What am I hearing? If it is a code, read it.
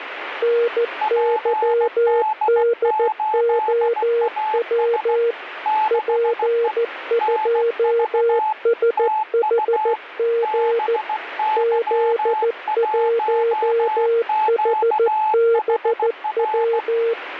Morse code, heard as two keyed tones, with radio static. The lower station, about 14 wpm, 470 Hz: NYDOW P2SHG Z1HBW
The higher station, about 16 wpm, 860 Hz: PD8AS 6E NV TU BY1QHR